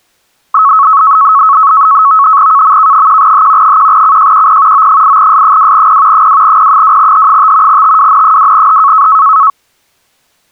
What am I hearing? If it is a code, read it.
NAVTEX (SITOR-B), 100 baud, 170 Hz shift, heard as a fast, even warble, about 1200 Hz centre. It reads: KMK1H 1CJQP O8S2P 2P2H5 TWN2H